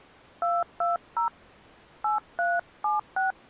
DTMF, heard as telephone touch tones, dialled by hand, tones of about 160 ms. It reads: 220 8376